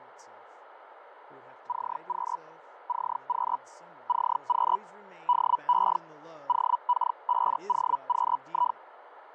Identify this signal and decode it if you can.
Hellschreiber (Feld-Hell, 122.5 baud), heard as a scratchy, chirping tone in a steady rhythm, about 980 Hz, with radio static, fading and speech in English. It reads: CQ CQ CQ DE OK5OQI